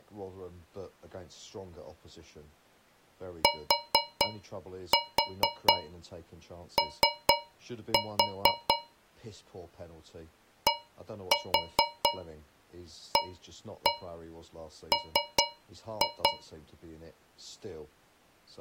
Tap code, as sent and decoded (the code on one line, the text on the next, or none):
4-4 3-4 / 1-4 1-1 3-2
TO DAM